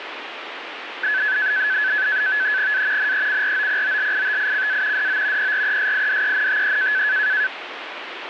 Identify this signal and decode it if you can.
NAVTEX (SITOR-B), 100 baud, 170 Hz shift, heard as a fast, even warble, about 1600 Hz centre, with radio static. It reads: A NECROPOLITICA DO PRESIDENTE